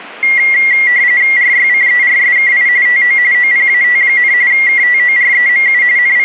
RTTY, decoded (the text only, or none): RYCERSKI TO OPAT, KTOREMU …